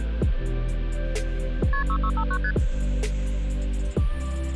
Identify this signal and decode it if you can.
Multi-frequency trunk signalling (R1, as on North American trunks), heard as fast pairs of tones, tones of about 70 ms. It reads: KP 6659 ST